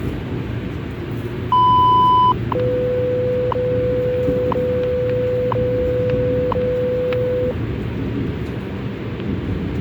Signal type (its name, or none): radio time signal